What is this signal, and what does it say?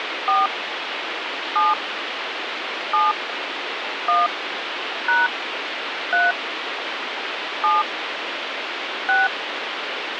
DTMF, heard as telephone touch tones, dialled by hand, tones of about 180 ms, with phone line noise. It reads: 4 7 7 1 # 3 7 6